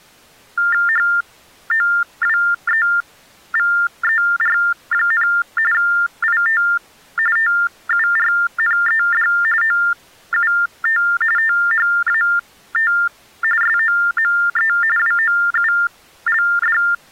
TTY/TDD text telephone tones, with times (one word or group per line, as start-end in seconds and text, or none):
0.9-5.3 HOWEVER,
5.7-6.6 IT
7.4-9.3 TURNED
9.6-11.0 OUT
11.4-12.9 THAT
13.6-14.7 SOME
15.0-16.8 WOULD